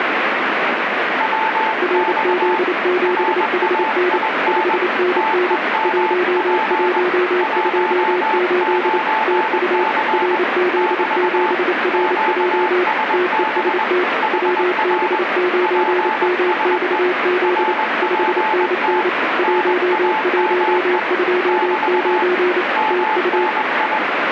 Morse code, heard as two keyed tones, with radio static. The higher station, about 21 wpm, 870 Hz: WX RAIN TEMP 19C <BT> QSB HR PSE RPT NAME <BT> MNI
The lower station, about 28 wpm, 360 Hz: RZ7HN 5NN 1128 TU RZ7RJ TEST WB9MXZ 5NN 1129 TU